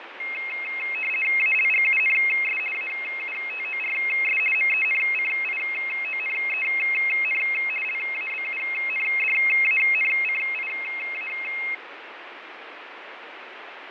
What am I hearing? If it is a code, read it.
RTTY (50 baud, 450 Hz shift), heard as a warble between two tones, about 2350 Hz centre, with radio static and fading. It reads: ALGUNS AUTORS MENCIONEN LABUNDANCIA